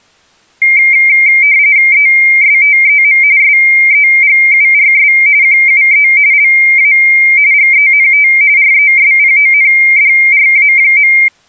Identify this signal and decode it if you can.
RTTY (45.45 baud, 170 Hz shift), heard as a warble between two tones, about 2200 Hz centre. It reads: ESTEM SEGURS QUE LA GENT RESPONDRA.